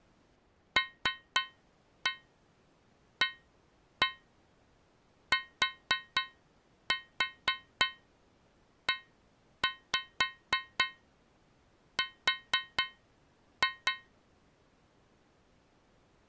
Tap code, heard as taps on a metal pipe, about 4 knocks a second. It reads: LATER